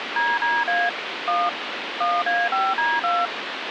DTMF, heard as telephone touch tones, dialled by machine, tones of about 220 ms, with phone line noise. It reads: DDA 1 1A5D2